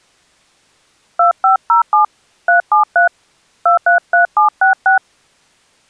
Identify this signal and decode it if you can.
DTMF, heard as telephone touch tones, dialled by hand, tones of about 120 ms. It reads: 2507 373 233766